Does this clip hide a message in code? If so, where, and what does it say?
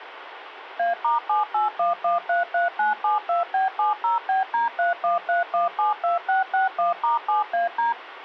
Yes: DTMF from 0.8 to 7.9 s, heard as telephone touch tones, dialled by machine, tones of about 140 ms, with radio hiss. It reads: A*781133972B70BD313172661*7AD